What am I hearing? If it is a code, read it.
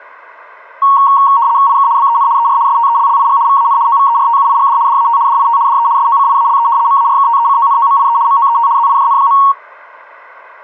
RTTY (75 baud, 170 Hz shift), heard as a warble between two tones, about 1020 Hz centre. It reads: IK BEN ER STELLIG VAN OVERTUIGD DAT DIT DE SOCIALE MARKTECONOMIE MOET ZIJN.